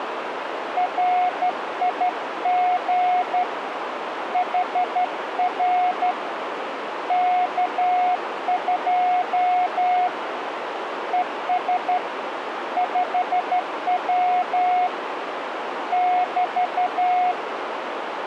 Morse code, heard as a keyed tone, hand-sent with a straight key, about 12 wpm, 720 Hz, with radio static and a narrow filter. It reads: RIG HR K2 ES 5W <BT>